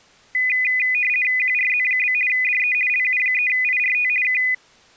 RTTY (50 baud, 450 Hz shift), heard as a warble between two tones, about 2250 Hz centre. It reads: QRZ? DE LU3IRT K